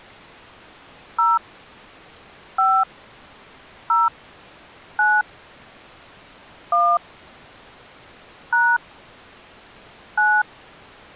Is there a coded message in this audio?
Yes: DTMF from 1.2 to 10.4 s, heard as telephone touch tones, dialled by hand, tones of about 230 ms. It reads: 0 5 0 9 1 # 9